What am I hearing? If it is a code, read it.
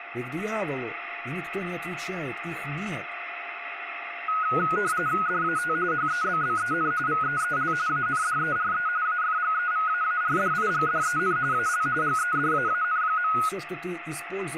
RTTY (45.45 baud, 170 Hz shift), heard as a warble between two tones, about 1360 Hz centre, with radio static, a steady whistle near 700 Hz and speech in Russian. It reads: DAT HEBBEN VEEL ANDERE AFGEVAARDIGDEN AL GEDAAN.